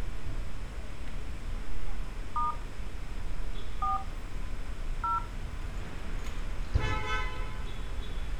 DTMF, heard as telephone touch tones, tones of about 150 ms, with street noise. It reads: * 4 0